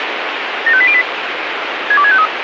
Five-tone selective call (ZVEI), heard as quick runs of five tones, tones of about 70 ms, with radio hiss. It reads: 75808 62653